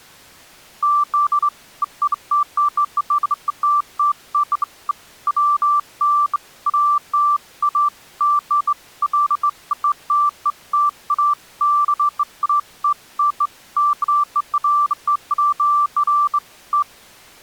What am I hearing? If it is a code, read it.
Beeps of irregular length. There is no code.